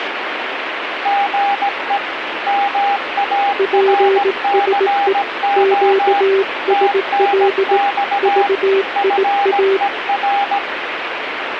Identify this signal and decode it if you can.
Morse code, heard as two keyed tones, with radio static. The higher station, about 17 wpm, 800 Hz: GE MARCO TNX FER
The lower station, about 18 wpm, 390 Hz: PSE QSL VIA